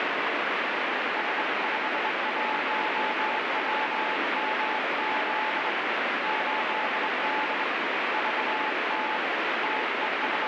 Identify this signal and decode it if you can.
Morse code, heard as a keyed tone, hand-sent with a straight key, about 23 wpm, 860 Hz, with heavy radio static. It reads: S51WMZ 8D VT …